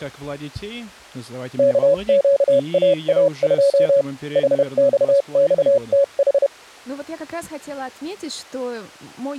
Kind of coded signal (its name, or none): Morse code